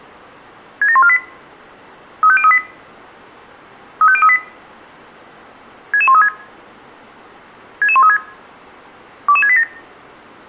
Five-tone selective call (ZVEI), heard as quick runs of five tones, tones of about 70 ms, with room echo. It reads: 67148 35038 35038 66136 66136 22687